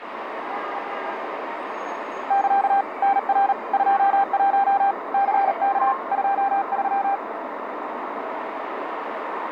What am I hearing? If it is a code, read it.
Morse code, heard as a keyed tone, hand-sent with a paddle, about 38 wpm, 790 Hz, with street noise. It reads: <KA> NR 21 CK 23